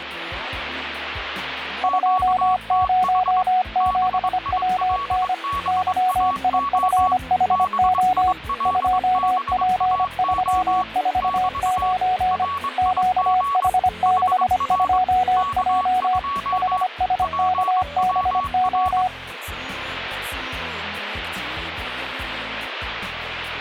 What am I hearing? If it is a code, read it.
Morse code, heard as two keyed tones, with radio static. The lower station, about 25 wpm, 740 Hz: 207WN YIFHO 2P349 QH62J HSKBO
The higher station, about 22 wpm, 1120 Hz: QTH BILBAO BILBAO <BT> RIG HR K2 PWR